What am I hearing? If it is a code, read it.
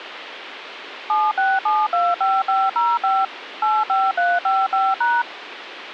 DTMF, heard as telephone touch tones, dialled by machine, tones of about 220 ms, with phone line noise. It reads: 76725505 85355#